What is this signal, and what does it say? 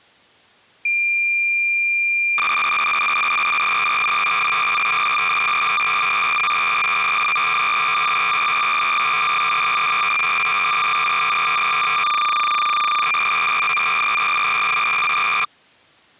Cassette data (Kansas City type), 300 baud, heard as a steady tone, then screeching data.